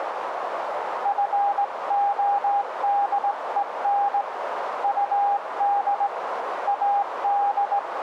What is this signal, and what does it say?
Morse code, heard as a keyed tone, hand-sent with a straight key, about 18 wpm, 810 Hz, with radio static and a narrow filter. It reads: FODEN UD AD